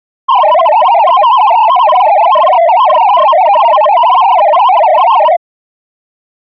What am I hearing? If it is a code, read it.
Multi-tone FSK (Olivia or MFSK type), about 500 Hz wide, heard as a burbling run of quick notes, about 62.5 baud.